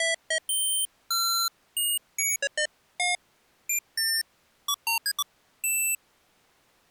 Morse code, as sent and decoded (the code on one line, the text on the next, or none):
none